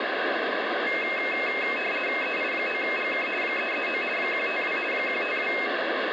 RTTY (50 baud, 450 Hz shift), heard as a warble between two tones, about 2350 Hz centre, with radio static. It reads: EI9GK 339 152 152